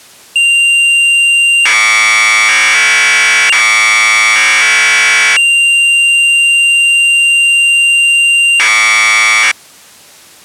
Commodore tape loading (standard loader), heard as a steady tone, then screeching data.